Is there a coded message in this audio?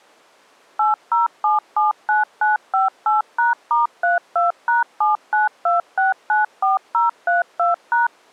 Yes: DTMF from 0.8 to 8.1 s, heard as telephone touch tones, dialled by machine, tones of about 150 ms. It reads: 80779958#*32#792694032#